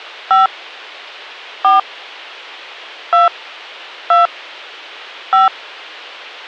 DTMF, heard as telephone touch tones, dialled by hand, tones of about 150 ms. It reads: 5 4 2 2 5